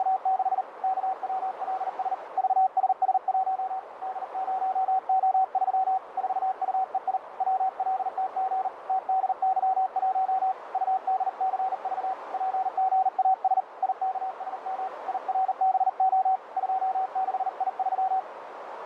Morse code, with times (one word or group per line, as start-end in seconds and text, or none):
0.0-0.6 …
0.8-2.1 KWLS
2.4-3.8 VSS1
4.0-6.0 D0O3
6.2-7.2 4UEI
7.4-8.7 WLTG
8.9-10.5 TDY1
10.7-12.1 UDCV
12.3-13.6 PGAS
13.8-14.9 IKSM
15.1-16.4 IRBO
16.6-18.2 26I3